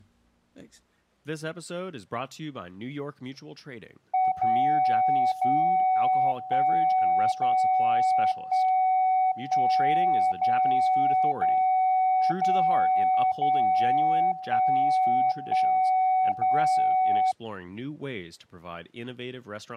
Radio time signal (DCF77), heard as a tone whose level steps once a second, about 750 Hz, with speech in English. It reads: 0 0 1 0 1 1 0 0 0 0 1 1 0